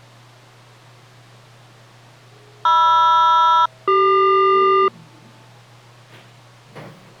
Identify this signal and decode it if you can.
Aircraft SELCAL, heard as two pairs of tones, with the noise inside a lift. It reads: MR-CQ